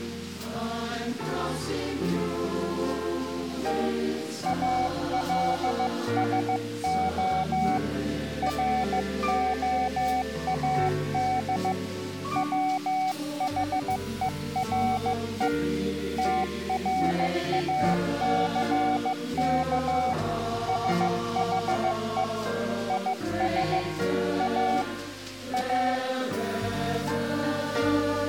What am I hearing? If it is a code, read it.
Morse code, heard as a keyed tone, hand-sent with a paddle, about 15 wpm, 750 Hz. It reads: ALSO ROAD WHERE TRACK SHE IS A A